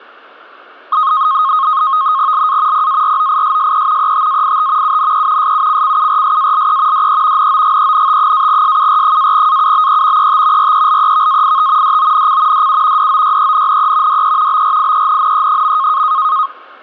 NAVTEX (SITOR-B), 100 baud, 170 Hz shift, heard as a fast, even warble, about 1160 Hz centre. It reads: LA PAROISSE ETAIT UNE SUCCURSALE DE NOGENT-SUR-AUBE ET RELEVAIT DONC DU DOYENNE DE BRIENNE.